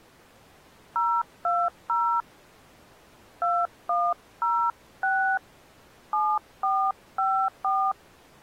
DTMF, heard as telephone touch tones, dialled by hand, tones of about 290 ms. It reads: 020 2106 7454